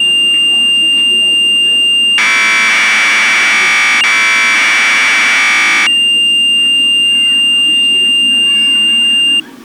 Commodore tape loading (standard loader), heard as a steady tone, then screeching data, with the noise of a park.